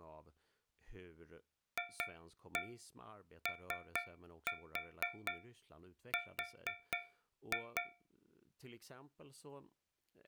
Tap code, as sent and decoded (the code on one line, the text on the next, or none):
2-1 3-4 4-2
FOR